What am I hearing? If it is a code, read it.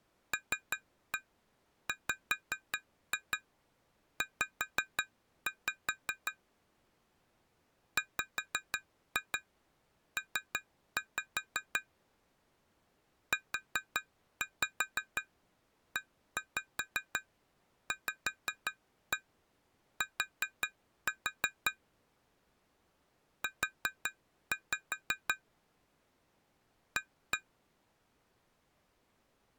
Tap code, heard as taps on glass, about 5 knocks a second. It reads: LWZ WP UEVT U A